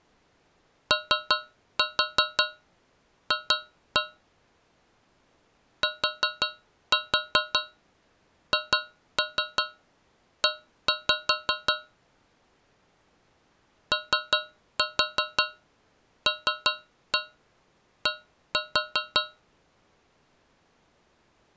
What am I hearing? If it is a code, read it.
Tap code, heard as taps on a metal pipe, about 5 knocks a second. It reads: OF THE OLD